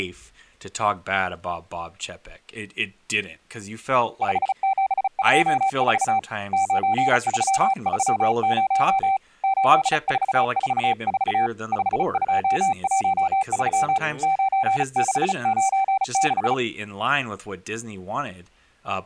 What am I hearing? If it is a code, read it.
Morse code, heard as a keyed tone, hand-sent with a bug key, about 35 wpm, 780 Hz, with speech in English. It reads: 5724 9330 8444 5213 9696